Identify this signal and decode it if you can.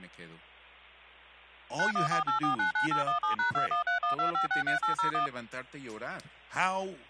DTMF, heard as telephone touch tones, dialled by machine, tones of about 120 ms, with hum and speech in English. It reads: 9148499817#21312563801